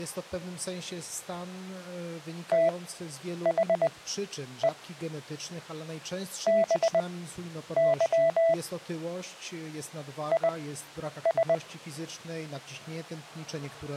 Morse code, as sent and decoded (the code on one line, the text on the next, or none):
- .... . / -... -.-- / .. ...
THE BY IS